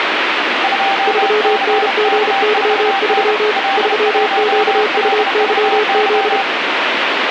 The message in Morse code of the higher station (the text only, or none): 2CK4N L1LVY